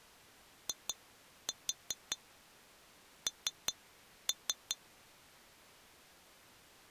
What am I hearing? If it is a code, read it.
Tap code, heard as taps on glass, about 5 knocks a second. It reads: IN